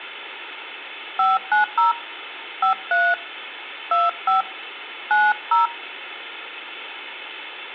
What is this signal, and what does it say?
DTMF, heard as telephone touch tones, dialled by hand, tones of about 170 ms. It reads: 590 53 25 90